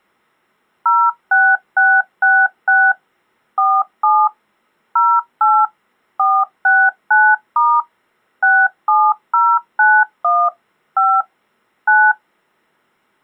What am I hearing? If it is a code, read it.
DTMF, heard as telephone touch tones, dialled by machine, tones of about 240 ms. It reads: 06666 47 08 469* 67091 5 9